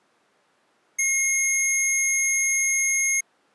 A steady tone. There is no code.